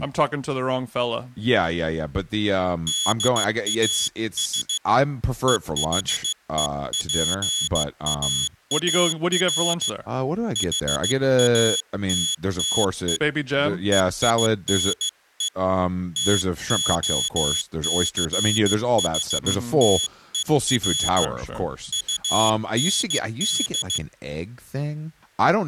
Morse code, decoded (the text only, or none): DAS EHEPAAR HATTE EINE TOCHTER UND